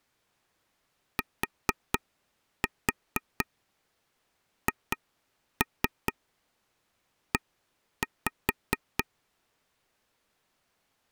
Tap code, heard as taps on a table, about 4 knocks a second. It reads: THE